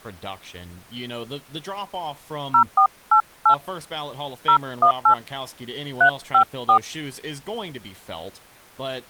DTMF, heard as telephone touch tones, dialled by hand, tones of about 90 ms, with speech in English. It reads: 0488 018 354